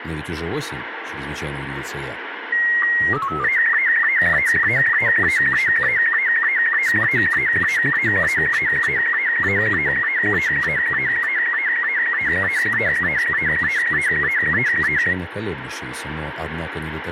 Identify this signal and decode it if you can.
SSTV (slow-scan television), Robot 72, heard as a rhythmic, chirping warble, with radio static.